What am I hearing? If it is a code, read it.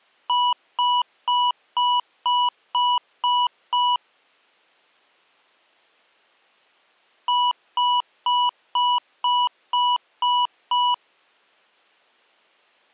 Beep code, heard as beeps from a small speaker, played twice, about 980 Hz. 8 short. In AMI BIOS tables: display memory failure; in Dell tables: LCD failure.